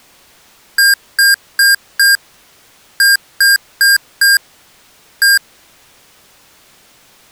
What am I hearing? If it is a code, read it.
Beep code, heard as beeps from a small speaker, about 1600 Hz. 4-4-1. In Phoenix BIOS tables: serial port failure.